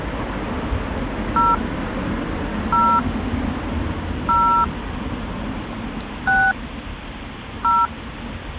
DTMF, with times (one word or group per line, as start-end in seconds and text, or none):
1.4-1.5 0
2.7-3.0 0
4.3-4.6 0
6.3-6.5 6
7.6-7.9 0